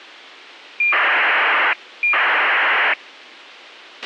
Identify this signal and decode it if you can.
ACARS aircraft data, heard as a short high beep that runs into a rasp, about 2400 baud, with a squelch burst at the end.